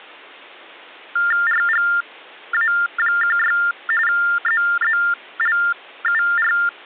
TTY/TDD text telephone tones (45.45 baud Baudot), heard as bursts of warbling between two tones, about 400 Hz shift, 1600 Hz centre. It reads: RGA16 ZZLUR